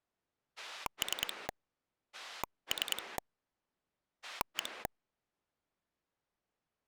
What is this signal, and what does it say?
Pulse dialling, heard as a rotary dial, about 10 pulses a second. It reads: 3 3 1